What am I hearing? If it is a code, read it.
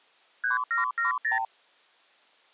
Multi-frequency trunk signalling (R2, with the far end's replies), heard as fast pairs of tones, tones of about 140 ms. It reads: 3770